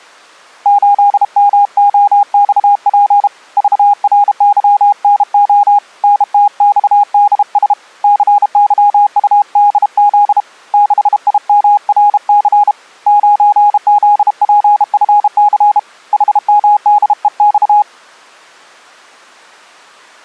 Morse code, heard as a keyed tone, hand-sent with a bug key, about 32 wpm, 820 Hz. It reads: 8MOXP VRYNO NTXDS CYUDZ 6IMRC 9ZPFC HMDEX